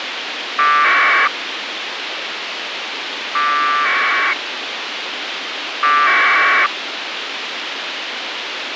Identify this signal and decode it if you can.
Packet radio (AX.25, as in APRS), 1200 baud, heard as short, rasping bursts, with radio hiss.